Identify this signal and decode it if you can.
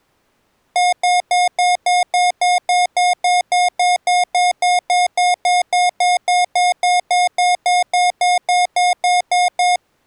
Evenly repeated beeps. There is no code.